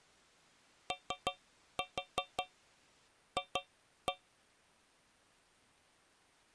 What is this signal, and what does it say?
Tap code, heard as taps on a metal pipe, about 5 knocks a second. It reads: OF